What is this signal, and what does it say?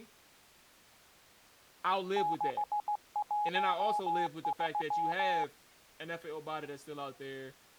Morse code, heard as a keyed tone, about 16 wpm, 830 Hz, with speech in English. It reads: 613